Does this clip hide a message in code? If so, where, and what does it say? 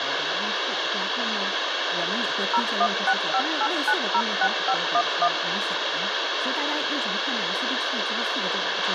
Yes: DTMF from 2.5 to 5.3 s, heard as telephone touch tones, dialled by machine, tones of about 60 ms, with radio hiss, a squelch burst at the end and speech in Chinese. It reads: 01658906511